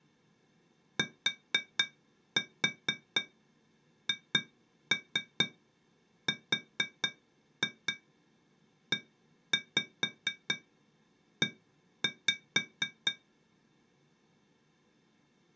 Tap code, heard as taps on glass, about 4 knocks a second. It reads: THREE